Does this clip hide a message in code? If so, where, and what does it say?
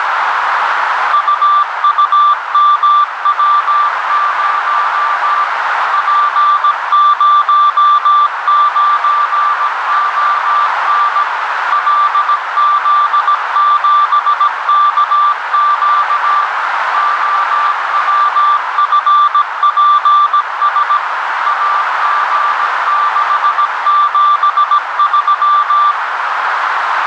Yes: Morse code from 1.1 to 26.0 s, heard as a keyed tone, machine-sent, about 17 wpm, 1180 Hz, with heavy radio static and a narrow filter. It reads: UUMW0 P09ON LZ7KQ OWFPS AG673